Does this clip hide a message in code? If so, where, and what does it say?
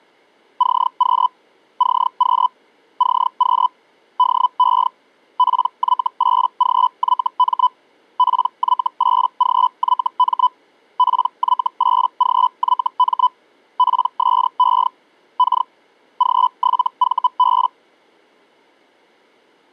Yes: Hellschreiber (Feld-Hell, 122.5 baud) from 0.6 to 17.7 s, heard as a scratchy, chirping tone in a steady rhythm, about 1000 Hz. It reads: CQ CQ CQ DE PY8GYM PY8GYM PY8GYM PSE K G7VB